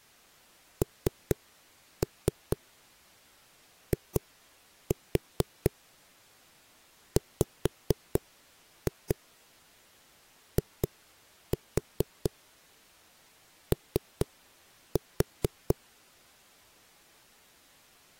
Tap code, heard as knocks on a wall, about 4 knocks a second. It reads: NIWIO